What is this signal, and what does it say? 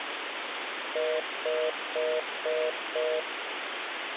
Telephone call progress tone (North American plan), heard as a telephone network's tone, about 480, 620 Hz, 0.25 s on and 0.25 s off, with phone line noise. Congestion tone.